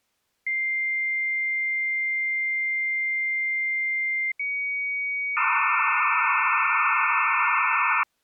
Dial-up modem handshake (low-speed, two carriers), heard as two whistles, then hiss.